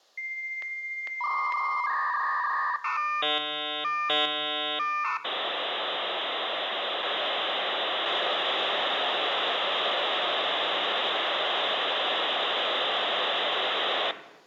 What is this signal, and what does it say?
Dial-up modem handshake (V.34 or later), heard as a whistle, warbles, then hiss.